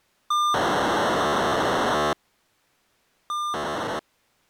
POCSAG pager data (2400 baud), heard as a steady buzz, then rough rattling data.